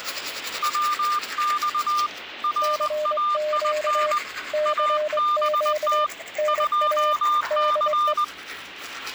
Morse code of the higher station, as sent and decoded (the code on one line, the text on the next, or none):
.-- -..- / .-. .- .. -. / .- -... - / ..--- -.-.
WX RAIN ABT 2C